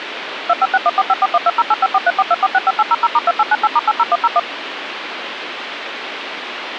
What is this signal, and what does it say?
DTMF, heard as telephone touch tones, dialled by machine, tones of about 40 ms, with phone line noise. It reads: 2561454120854342465800*2898*80101